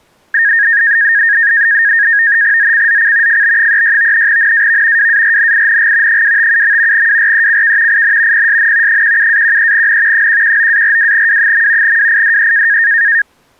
NAVTEX (SITOR-B), 100 baud, 170 Hz shift, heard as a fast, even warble, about 1750 Hz centre. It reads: ZCZC FB36 NAV WARNING 257. WRECK IN PSN 17-13N 119-42W. WIDE